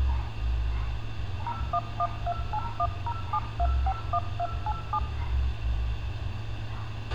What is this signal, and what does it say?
DTMF, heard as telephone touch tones, dialled by machine, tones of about 60 ms, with radio hiss, a squelch burst at the end and street noise. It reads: 01128107251287